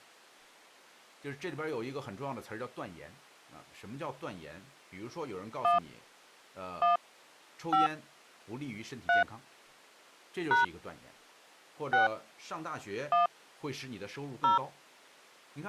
DTMF, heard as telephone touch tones, dialled by hand, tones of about 140 ms, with speech in Chinese. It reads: 1 1 5 3 # 6 1 0